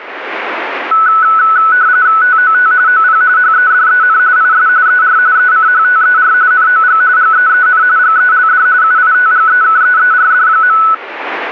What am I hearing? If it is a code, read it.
RTTY (45.45 baud, 170 Hz shift), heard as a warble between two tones, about 1390 Hz centre. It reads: TOT OP HEDEN IS ER ECHTER NOG GEEN GELD UITGEKEERD.